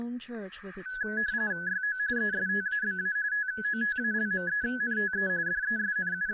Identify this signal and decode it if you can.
RTTY (45.45 baud, 170 Hz shift), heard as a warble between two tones, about 1600 Hz centre, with static crashes and speech in English. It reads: YO ESTABA TOTALMENTE …